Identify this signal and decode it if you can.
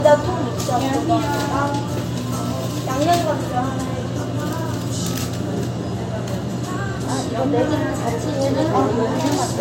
The noise of a restaurant. There is no code.